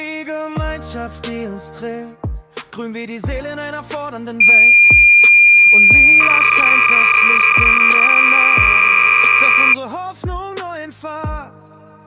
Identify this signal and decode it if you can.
Cassette data (Kansas City type), 300 baud, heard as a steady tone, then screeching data.